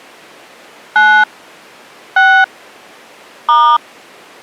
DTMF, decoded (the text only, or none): 9 6 *